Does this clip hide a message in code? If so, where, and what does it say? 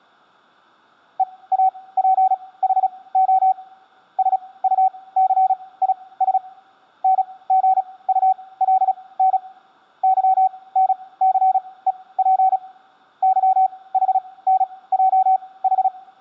Yes: Morse code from 1.1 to 15.9 s, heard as a keyed tone, machine-sent, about 36 wpm, spaced as for 21 wpm, 760 Hz, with room echo. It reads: EAPHO SUCIS NGULN YNCEP YHNJH